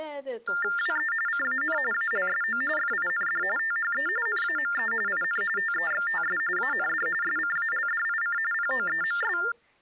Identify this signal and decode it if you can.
TTY/TDD text telephone tones (45.45 baud Baudot), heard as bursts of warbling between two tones, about 400 Hz shift, 1600 Hz centre, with speech in Hebrew. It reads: WE CAN ALSO FIND THE NAME IN TEXTS AND SCALDIC POEMS